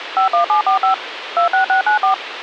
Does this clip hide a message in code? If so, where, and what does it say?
Yes: DTMF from 0.2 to 2.1 s, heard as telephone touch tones, dialled by machine, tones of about 110 ms, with radio hiss. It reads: 51745 26694